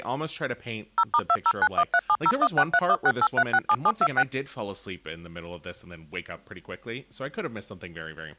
DTMF, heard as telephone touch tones, dialled by machine, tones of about 60 ms, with speech in English. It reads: 0*2091370163168367726